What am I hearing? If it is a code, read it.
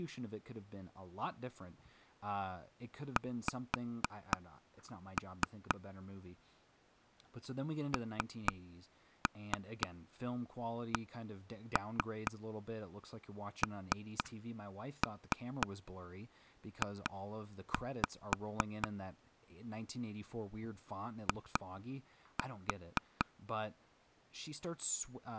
Tap code, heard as taps on a table, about 4 knocks a second, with speech in English. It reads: X NCNJ I